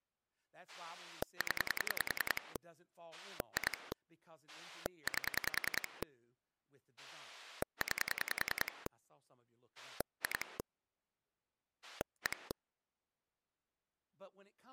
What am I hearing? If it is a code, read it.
Pulse dialling, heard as a rotary dial, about 10 pulses a second, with speech in English. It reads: 0 2 8 9 2 1